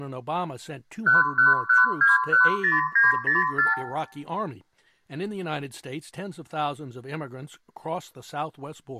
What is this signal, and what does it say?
Multi-frequency trunk signalling (R2, with the far end's replies), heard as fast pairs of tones, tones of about 160 ms, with room echo. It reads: 111210904